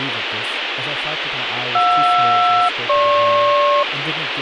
Aircraft SELCAL, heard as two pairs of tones, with radio hiss and speech in English. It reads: JR-GP